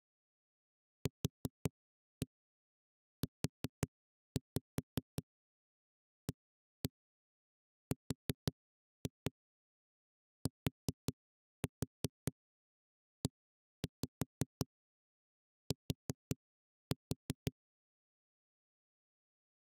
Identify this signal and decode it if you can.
Tap code, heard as knocks on a wall, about 5 knocks a second. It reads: QUARTET